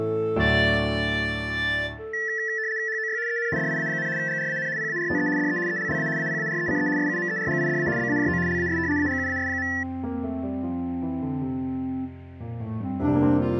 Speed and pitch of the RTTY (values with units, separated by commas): 75 baud, 170 Hz shift, 1850 Hz centre